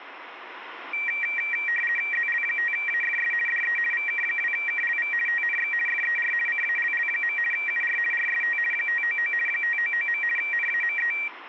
RTTY (50 baud, 450 Hz shift), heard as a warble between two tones, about 2100 Hz centre. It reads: ZL5AFS DE VK2KLV TNX FER CALL. UR RST 599 599. NAME